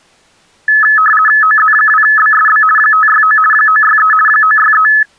RTTY (50 baud, 450 Hz shift), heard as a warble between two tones, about 1500 Hz centre. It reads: OZ2BSB 569 963 963